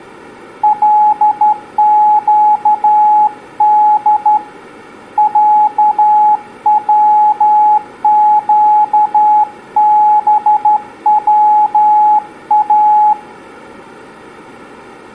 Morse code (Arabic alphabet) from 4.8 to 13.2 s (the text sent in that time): عوقبوا